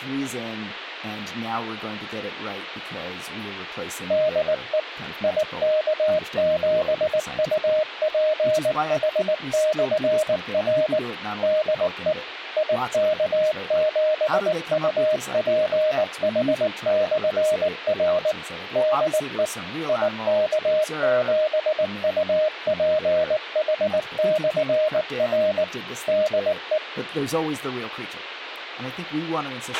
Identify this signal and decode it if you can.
Morse code, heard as a keyed tone, machine-sent, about 19 wpm, 620 Hz, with radio hiss, a squelch burst at the end and speech in English. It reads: DE IK7UPH/R DE IK7UPH/R DE IK7UPH/R DE